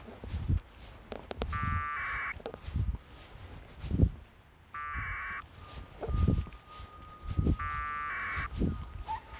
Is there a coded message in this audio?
Yes: packet radio (AX.25, as in APRS), 1200 baud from 1.5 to 8.5 s, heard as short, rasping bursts, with a squelch burst at the end and the noise of a residential street.